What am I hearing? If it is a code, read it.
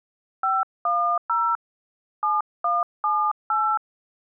DTMF, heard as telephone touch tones, dialled by hand, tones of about 250 ms. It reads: 510 7178